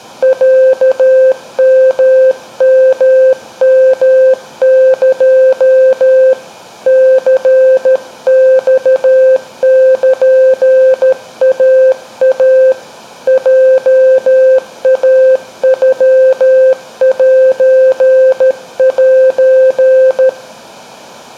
Morse code (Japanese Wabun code), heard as a keyed tone, hand-sent with a paddle, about 13 wpm, 520 Hz, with room echo. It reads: ロヨヨヨエ ニマルイイ ヲイノセセ